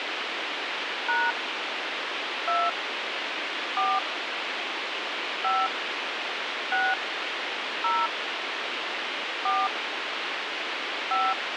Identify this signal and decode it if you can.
DTMF, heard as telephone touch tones, dialled by hand, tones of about 220 ms, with radio hiss. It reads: # 2 4 5 6 0 4 5